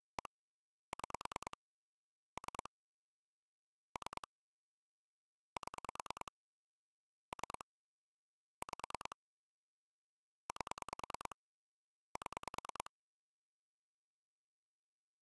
Pulse dialling, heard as clicks on a phone line, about 9 pulses a second. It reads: 1 6 3 3 7 3 5 8 7